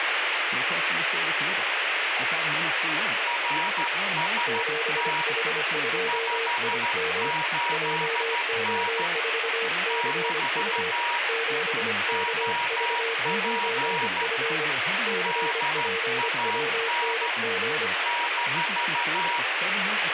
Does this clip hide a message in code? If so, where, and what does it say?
Yes: Morse code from 3.2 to 19.5 s, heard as two keyed tones, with heavy radio static. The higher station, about 13 wpm, 950 Hz: RST 58N - OP DAN -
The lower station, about 25 wpm, 460 Hz: 7H2IM JO4CU 7KV9F CPWNG